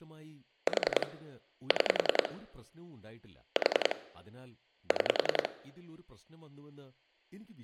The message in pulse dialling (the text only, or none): 4 6 4 6